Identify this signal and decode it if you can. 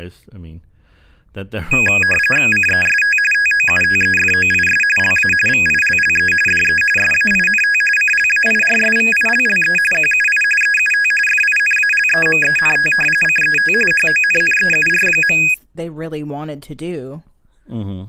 RTTY (45.45 baud, 850 Hz shift), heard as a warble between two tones, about 2100 Hz centre, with speech in English. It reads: CEST TOUTEFOIS LA VILLE DE SAINT CLAIRSVILLE QUI EUT FINALEMENT CET HONNEUR.